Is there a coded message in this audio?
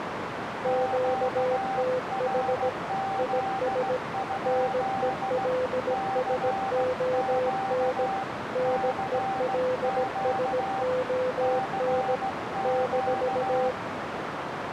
Yes: Morse code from 0.6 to 13.8 s, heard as two keyed tones, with radio static and a narrow filter. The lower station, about 17 wpm, 510 Hz: QTH IS NELSON NELSON -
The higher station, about 16 wpm, 780 Hz: QRZ? CQ CQ CQ